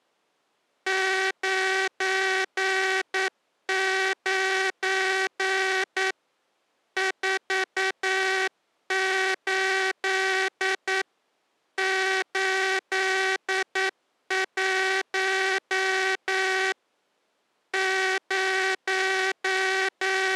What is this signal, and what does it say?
Morse code, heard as a buzzer, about 9 wpm. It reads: 99 48 81 …